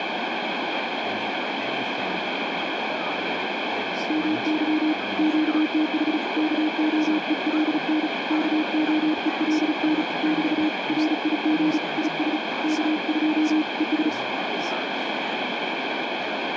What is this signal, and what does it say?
Morse code, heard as a keyed tone, hand-sent with a paddle, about 36 wpm, 310 Hz, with heavy radio static and speech in English. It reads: MY QTH KOELN KOELN <BT> RIG IS K2 ES